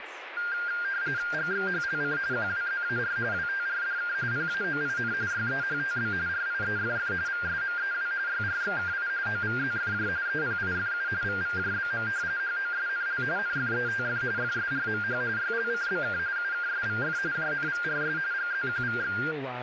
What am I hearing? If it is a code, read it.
RTTY (45.45 baud, 170 Hz shift), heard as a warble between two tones, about 1500 Hz centre, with radio static and speech in English. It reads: GXHLC QWZAR WTRDK PAOIN YEHTB RIEFF VSMEW YRXKI OVZFJ EPIFU VVJBM HOSNL NFETF FSRMH YLCBK UKSVF JNVRS GZQVX